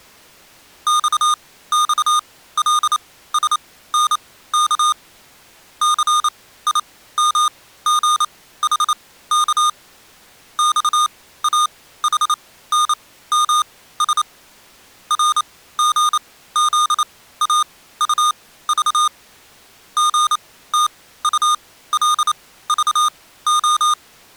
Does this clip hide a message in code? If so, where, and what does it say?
Yes: Morse code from 0.8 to 24.0 s, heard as electronic beeps, machine-sent, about 28 wpm, spaced as for 16 wpm, 1220 Hz. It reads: XXLSNK CIMGHK XAHNMS RGZAUV GTULVO